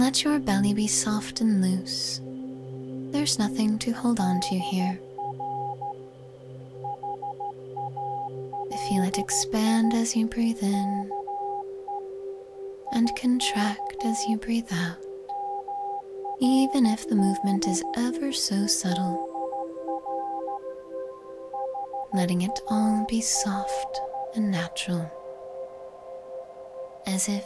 Morse code (Persian alphabet), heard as a keyed tone, hand-sent with a straight key, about 13 wpm, 810 Hz. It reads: در حالی که یک مرد در حال